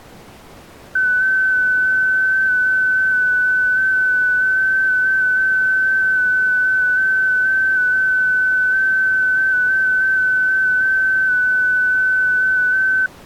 FT8 (one signal), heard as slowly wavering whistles, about 6.25 baud.